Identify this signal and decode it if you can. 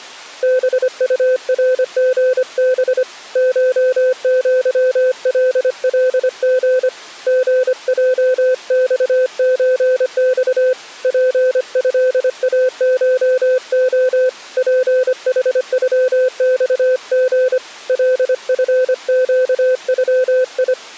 Morse code (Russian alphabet), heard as a keyed tone, hand-sent with a paddle, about 25 wpm, 510 Hz. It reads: БУРГБ ШЪЛЛГ ГЙЬЧЬ ПЭАШО ПХЮЬГ ЛФЩЮИ